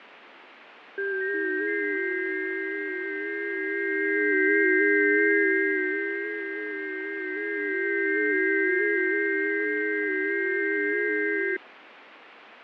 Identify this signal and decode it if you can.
FT8 (several signals at once), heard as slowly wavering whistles, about 6.25 baud, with radio static and fading.